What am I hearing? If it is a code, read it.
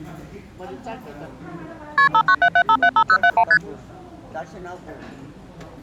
Multi-frequency trunk signalling (R1, as on North American trunks), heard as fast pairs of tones, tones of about 70 ms, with the noise of a restaurant. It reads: KP 5977575071 ST